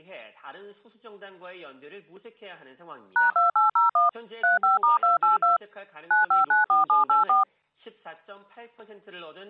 DTMF, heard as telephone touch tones, dialled by machine, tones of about 140 ms. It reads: #2801 35*282 9594784